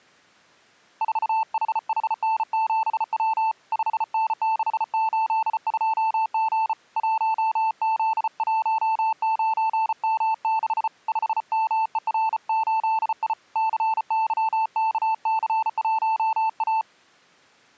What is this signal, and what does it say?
Morse code, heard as a keyed tone, hand-sent with a bug key, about 34 wpm, 890 Hz. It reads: 4HHN7W 5N682G 1Z19M6 5MER8I CYKC1A